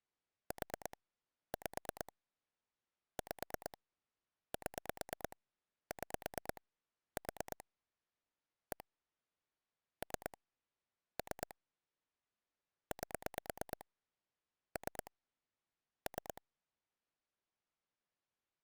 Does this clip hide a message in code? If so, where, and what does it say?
Yes: pulse dialling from 0.5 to 16.4 s, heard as clicks on a phone line, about 9 pulses a second. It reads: 4 5 5 7 6 4 1 3 3 8 3 3